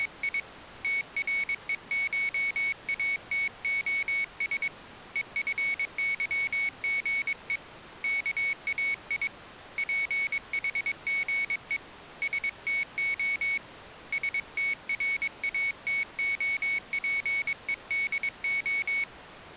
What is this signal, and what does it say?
Morse code (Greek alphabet), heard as a high beeper, hand-sent with a paddle, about 22 wpm, 2200 Hz. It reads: … ΤΡΕΧΑΤΟΣ ΕΦΥΓΕ ΚΑΙ ΠΗΓΕ ΣΤΟ ΣΤΡΑΤΟΠΕΔΟ